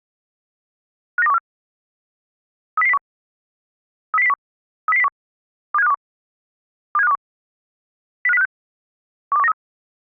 Five-tone selective call (EEA), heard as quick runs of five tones, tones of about 40 ms. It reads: 59214 30001 30001 30001 27521 27521 05056 12193